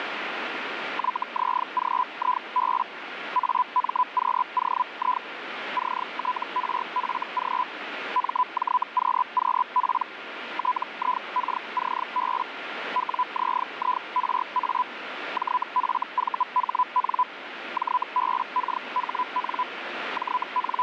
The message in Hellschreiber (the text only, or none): YZGIB AMQOI CTRFG MJQQP TIKCB WZIRA JFVHN JBKHN …